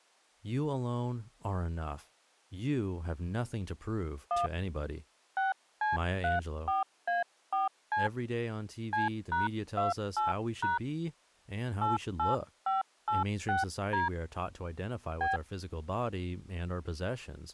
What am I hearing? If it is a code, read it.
DTMF, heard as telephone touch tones, dialled by hand, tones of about 150 ms, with speech in English. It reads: 1 6C34A4C C#28# 88586D B